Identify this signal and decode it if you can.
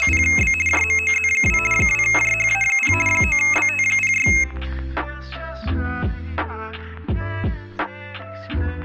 RTTY (50 baud, 450 Hz shift), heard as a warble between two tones, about 2350 Hz centre. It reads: … JMOZ2 2JHA0 9BT06